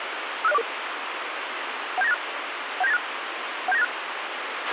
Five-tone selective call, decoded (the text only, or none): 56044 17986 17986 17986